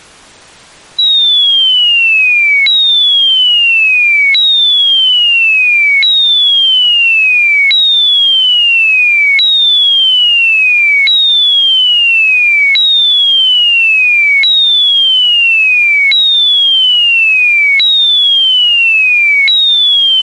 A tone that sweeps in pitch again and again. There is no code.